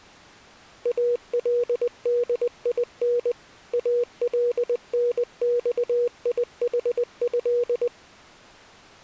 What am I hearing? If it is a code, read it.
Morse code (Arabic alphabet), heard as a keyed tone, machine-sent, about 20 wpm, 480 Hz. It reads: الدين النصيحه